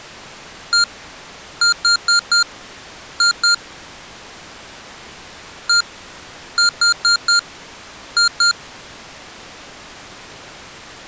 Beep code, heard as beeps from a small speaker, played twice, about 1400 Hz. 1-4-2. In Phoenix BIOS tables: parity failure in the first 64 KB of memory.